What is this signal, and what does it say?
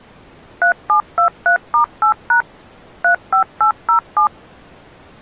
DTMF, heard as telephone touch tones, dialled by machine, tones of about 100 ms. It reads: 3723*8# 35807